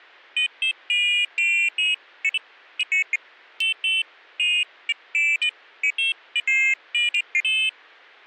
Pairs of high tones at irregular times. There is no code.